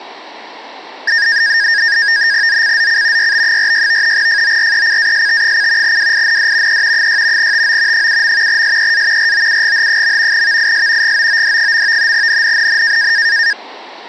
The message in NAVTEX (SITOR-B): ZCZC YB46 FORECAST: WIND E 6 TO 7. SEA ROUGH. VIS GOOD. NNNN

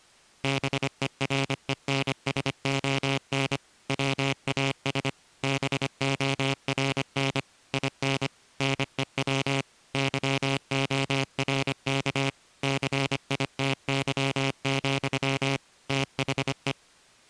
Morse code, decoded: BERENSON WAS BORN IN NEW YORK CITY, THE

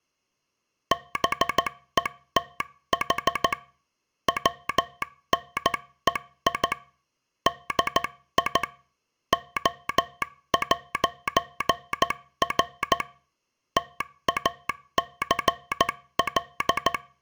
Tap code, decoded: none

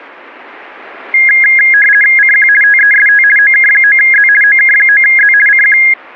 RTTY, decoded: CQ TEST OK9Z OK9Z CQ

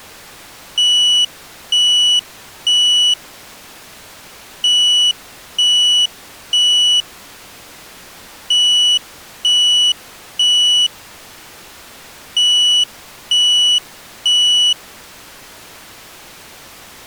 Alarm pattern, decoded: temporal three

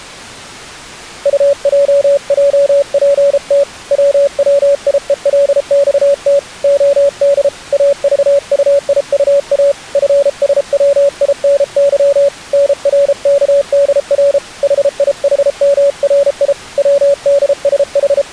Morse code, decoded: UJJPT WWIELXT OD AVUIUA FSWINY NRKDR HIHMRI …

